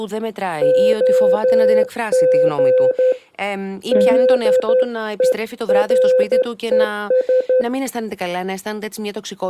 Morse code, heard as a keyed tone, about 12 wpm, 510 Hz, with speech in Greek. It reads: OG DERES